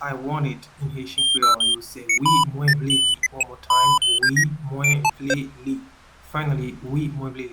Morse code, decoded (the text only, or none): none